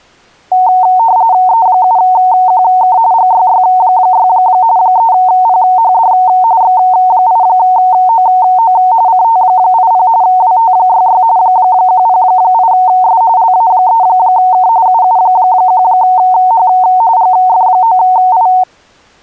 RTTY (45.45 baud, 170 Hz shift), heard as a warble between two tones, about 820 Hz centre. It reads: E7QK GYY6 3PHD X8OO CT80 WT66 108S LA3K UU1H GF9I